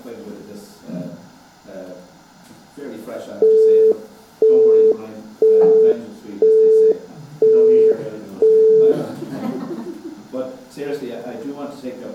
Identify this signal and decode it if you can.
Telephone call progress tone (single-tone plan, as in Europe, Japan and elsewhere), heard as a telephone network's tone, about 440 Hz, 0.5 s on and 0.5 s off. Busy tone.